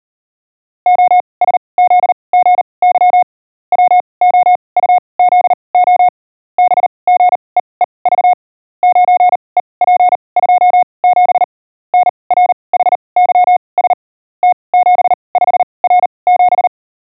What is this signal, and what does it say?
Morse code, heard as a keyed tone, machine-sent, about 39 wpm, spaced as for 26 wpm, 720 Hz. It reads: OSZGY WOUZO BGEEV 9EP27 NRHYS T75R7